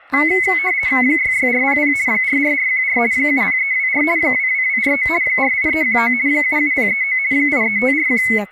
RTTY (50 baud, 170 Hz shift), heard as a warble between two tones, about 2100 Hz centre, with static crashes and speech in Santali. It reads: 66400 44414 70324 22249 48319 77039 83541